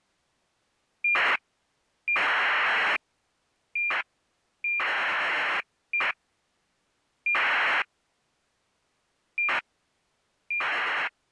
ACARS aircraft data, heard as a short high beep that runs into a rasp, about 2400 baud.